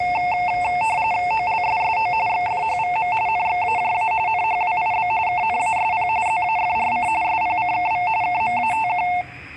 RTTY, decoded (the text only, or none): OLSSO XFHVM NXAJA NHWIB KNASP ZAFRC SPCKV KMATQ